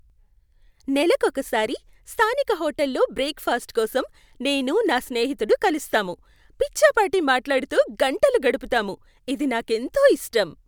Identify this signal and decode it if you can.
Speech in Telugu. There is no code.